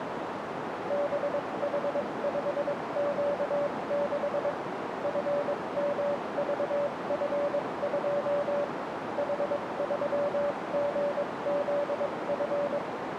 Morse code, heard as a keyed tone, machine-sent, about 22 wpm, spaced as for 19 wpm, 580 Hz, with radio static and a narrow filter. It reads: BH5Q6 FMVF2 H3GZF